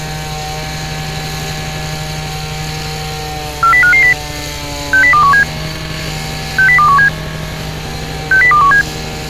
Five-tone selective call (CCIR), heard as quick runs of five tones, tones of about 100 ms, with street noise. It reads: 40550 60217 60217 60217